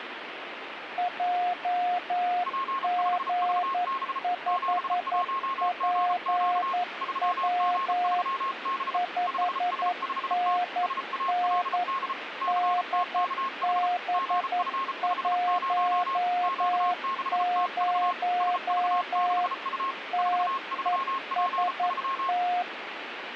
Morse code, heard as two keyed tones, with radio static. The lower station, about 11 wpm, 710 Hz: JG5PW 5NN DB10 TEST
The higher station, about 34 wpm, 1080 Hz: P5VB 71GQ 3G3B 5S5T SALD CTKH GF50 Q6TV SV6U 43P3